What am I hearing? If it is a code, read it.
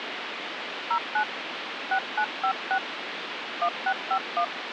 DTMF, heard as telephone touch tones, dialled by hand, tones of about 80 ms, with phone line noise. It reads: 09 6956 1651